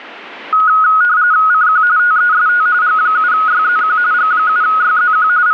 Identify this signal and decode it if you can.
RTTY (45.45 baud, 170 Hz shift), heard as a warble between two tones, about 1360 Hz centre, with static crashes. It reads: CQ TEST G7YZQ G7YZQ …